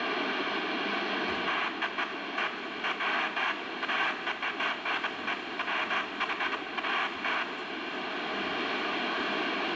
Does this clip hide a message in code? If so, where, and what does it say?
No, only bursts of noise, with radio static, room echo and the noise of a restaurant.